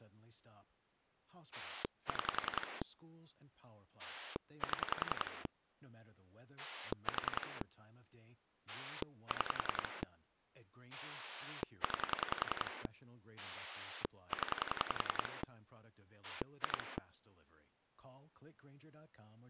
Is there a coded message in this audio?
Yes: pulse dialling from 1.5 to 17.0 s, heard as a rotary dial, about 10 pulses a second, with speech in English. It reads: 6 7 4 6 9 0 2